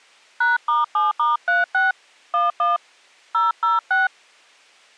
DTMF, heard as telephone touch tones, dialled by hand, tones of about 160 ms. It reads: #*7*36 11 006